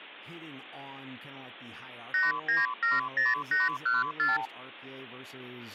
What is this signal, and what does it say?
Multi-frequency trunk signalling (R2, with the far end's replies), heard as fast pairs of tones, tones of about 170 ms, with speech in English. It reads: 8970814